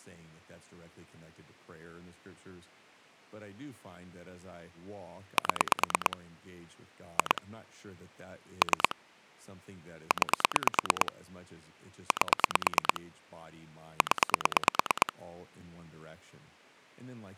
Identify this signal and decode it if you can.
Pulse dialling, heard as clicks on a phone line, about 9 pulses a second, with speech in English. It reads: 7 2 3 9 8 0